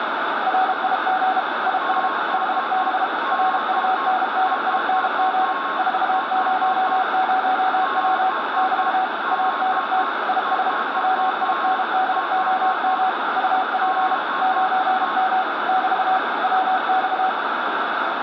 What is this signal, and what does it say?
Morse code, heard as two keyed tones, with heavy radio static. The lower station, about 32 wpm, 750 Hz: RIG IS HB RUNNING 400W <BT> ANT IS WINDOM UP 9M <BT> WX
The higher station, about 10 wpm, 1080 Hz: BD4H BD4H DE